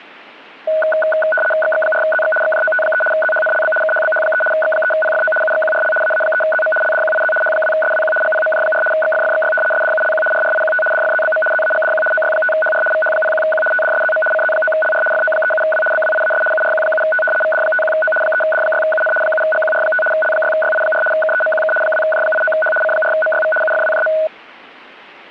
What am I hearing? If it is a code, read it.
RTTY (75 baud, 850 Hz shift), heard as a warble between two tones, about 1060 Hz centre. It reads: XX4ZX XJOT3 ZHNLB KHBH3 X3PFO UXQRL AA3ZM LDQIZ H2SWQ GPMJ4 XFFXY SDULQ RRIQT DFZBM ZAGDQ OY5HR VH01Q TDSZM CZ9LR FO37W BWIAS URQ7T VD51O 3D6UN 7GQR5 L6YI4 KEMQK 2J89H C4MYV UFWJM